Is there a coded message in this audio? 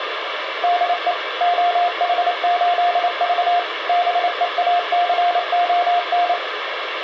Yes: Morse code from 0.6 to 6.4 s, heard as a keyed tone, machine-sent, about 28 wpm, 700 Hz, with radio hiss. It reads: DE OH8V BEACON